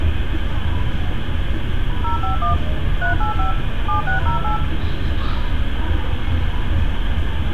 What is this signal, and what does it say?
DTMF, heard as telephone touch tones, dialled by machine, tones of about 120 ms, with phone line noise and street noise. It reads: 051 385 7608